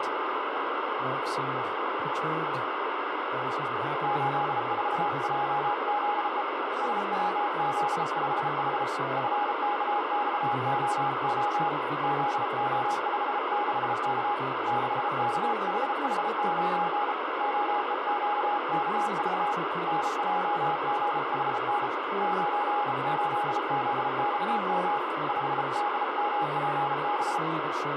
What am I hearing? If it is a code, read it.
Morse code, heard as a keyed tone, hand-sent with a bug key, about 33 wpm, 830 Hz, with heavy radio static and speech in English. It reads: 84JZE SWZ5H FKXOO ZO56K 6KHH9 OEQKV NJGHN 98ZXM 5DMPB